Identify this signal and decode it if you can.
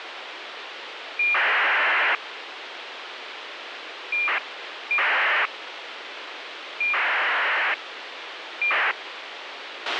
ACARS aircraft data, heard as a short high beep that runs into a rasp, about 2400 baud, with radio hiss and a squelch burst at the end.